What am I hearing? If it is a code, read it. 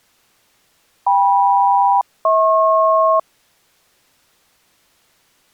Aircraft SELCAL, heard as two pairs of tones. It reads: KM-HP